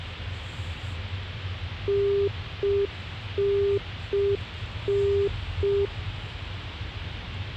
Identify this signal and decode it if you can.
Telephone call progress tone (UK plan), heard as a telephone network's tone, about 400 Hz, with the noise inside a car. Congestion tone.